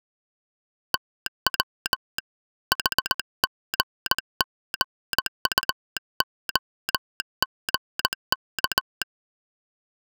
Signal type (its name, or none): Morse code